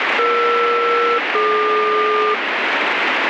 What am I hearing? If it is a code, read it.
Aircraft SELCAL, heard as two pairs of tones, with radio static. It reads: ER-DQ